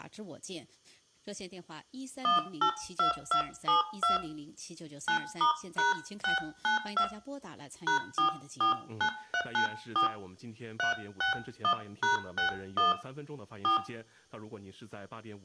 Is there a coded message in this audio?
Yes: DTMF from 2.2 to 13.8 s, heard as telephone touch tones, dialled by hand, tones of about 110 ms, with room echo. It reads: 182272 9*#692 #449394 361#61 4